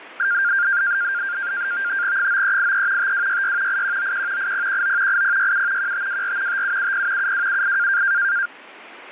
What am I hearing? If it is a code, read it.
NAVTEX (SITOR-B), 100 baud, 170 Hz shift, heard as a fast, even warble, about 1500 Hz centre, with radio static. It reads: 9383 5266 8191 8019 8067 1524 5770 7278